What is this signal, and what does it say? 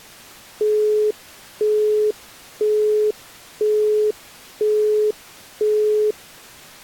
Telephone call progress tone (single-tone plan, as in Europe, Japan and elsewhere), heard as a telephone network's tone, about 420 Hz, 0.5 s on and 0.5 s off. Busy tone.